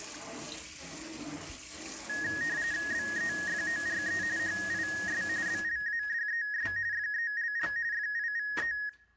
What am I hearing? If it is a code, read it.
RTTY (45.45 baud, 170 Hz shift), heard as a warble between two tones, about 1750 Hz centre, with room echo and kitchen noise. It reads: BEFORE HIS BLADES FELL FIVE